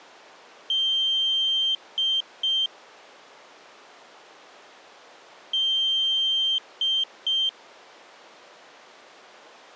Beep code, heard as a piezo beeper, played twice, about 3150 Hz. 1 long, 2 short. In Award, IBM and AMI BIOS tables: video adapter failure.